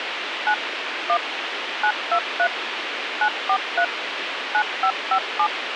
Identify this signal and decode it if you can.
DTMF, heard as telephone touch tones, dialled by machine, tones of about 70 ms, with radio hiss. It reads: 9 1 923 943 9557